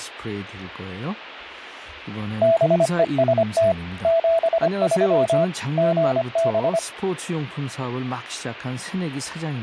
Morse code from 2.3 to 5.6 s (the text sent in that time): BEST 73